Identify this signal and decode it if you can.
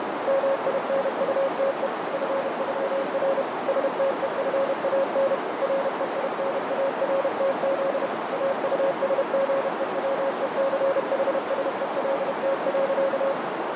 Morse code (with German letters), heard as a keyed tone, machine-sent, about 31 wpm, 540 Hz, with heavy radio static and a narrow filter. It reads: MINUTE FÜR STEFAN REINARTZ AUSGEWECHSELT.